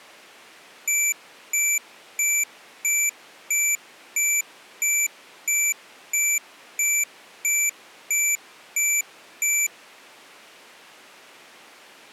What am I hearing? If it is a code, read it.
Evenly repeated beeps. There is no code.